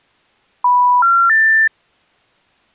Telephone call progress tone (North American plan), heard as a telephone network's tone, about 980, 1370, 1800 Hz. Special information tone.